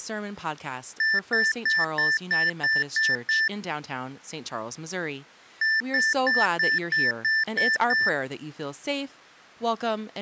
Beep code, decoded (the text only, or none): 8 short